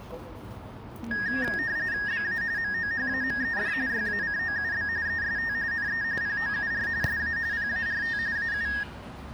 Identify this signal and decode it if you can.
RTTY (45.45 baud, 170 Hz shift), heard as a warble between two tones, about 1750 Hz centre, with the noise of a park. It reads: BA MOHAMED YACOUB EST NE POUR SA PART AU